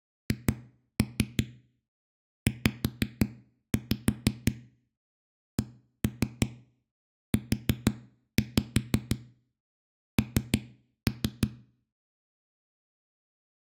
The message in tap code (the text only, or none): HZCUN